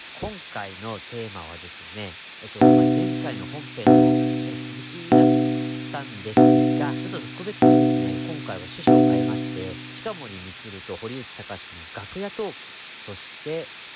Clock strike, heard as a bell, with speech in Japanese. 6. Six o'clock.